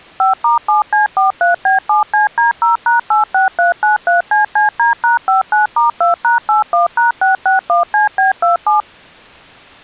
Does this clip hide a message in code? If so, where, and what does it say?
Yes: DTMF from 0.2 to 8.8 s, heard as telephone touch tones, dialled by machine, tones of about 140 ms. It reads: 5*7C43B7CD0#86393CCD#59*2#81#661CB27